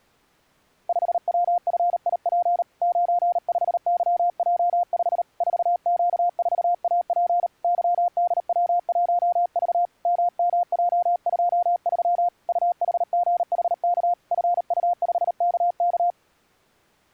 Morse code, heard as a keyed tone, hand-sent with a paddle, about 38 wpm, 710 Hz. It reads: 5WFIP 95YJ5 4Q4AP YDW1V MMJ23 UHGHK FU5KK